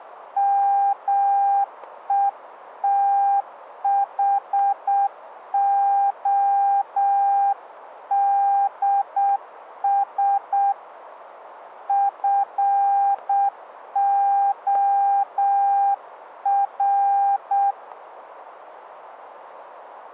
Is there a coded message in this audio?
Yes: Morse code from 0.3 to 17.8 s, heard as a keyed tone, hand-sent with a paddle, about 7 wpm, 800 Hz, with radio static and static crashes. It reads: METHODS FOR